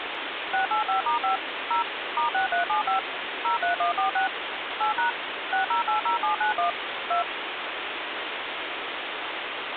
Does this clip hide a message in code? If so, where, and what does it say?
Yes: DTMF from 0.5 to 7.2 s, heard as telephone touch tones, dialled by machine, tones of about 120 ms, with phone line noise. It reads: 685*5 0 *6375 03146 8# 6080791 2